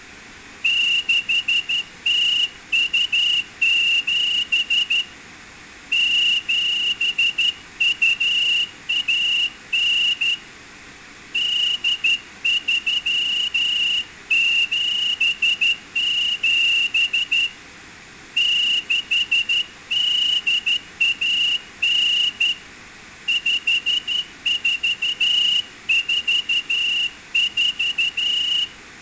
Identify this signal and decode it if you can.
Morse code (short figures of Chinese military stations), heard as a whistle, hand-sent with a straight key, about 12 wpm, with room echo. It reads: 6027 7219 8377 6819 5444